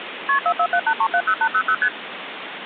Multi-frequency trunk signalling (R1, as on North American trunks), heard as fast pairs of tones, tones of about 70 ms, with phone line noise. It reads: KP 4478370800 ST